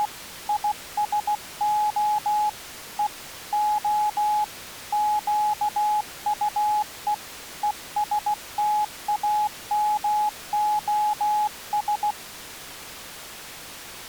Morse code, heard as a keyed tone, hand-sent with a bug key, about 16 wpm, 840 Hz. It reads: … ISO E O QUE ESTAMOS